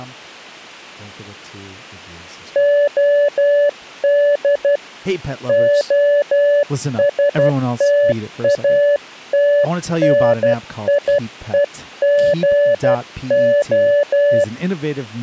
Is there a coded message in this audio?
Yes: Morse code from 2.5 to 14.5 s, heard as a keyed tone, hand-sent with a paddle, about 12 wpm, 580 Hz, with speech in English. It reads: OD OSTATNIEGO